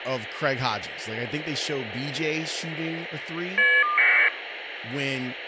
Caller ID data burst, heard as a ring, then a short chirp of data, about 1200 baud, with phone line noise and speech in English.